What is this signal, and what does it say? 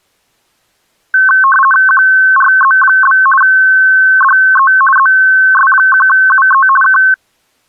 RTTY (50 baud, 450 Hz shift), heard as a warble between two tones, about 1310 Hz centre. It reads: QRZ? DE ZS1UE K